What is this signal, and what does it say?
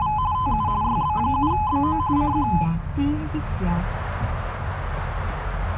RTTY (45.45 baud, 170 Hz shift), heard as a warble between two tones, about 940 Hz centre, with radio static and the noise inside a car. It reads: … TU YB7BO CQ